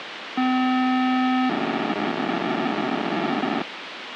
POCSAG pager data (512 baud), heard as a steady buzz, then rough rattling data, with radio hiss.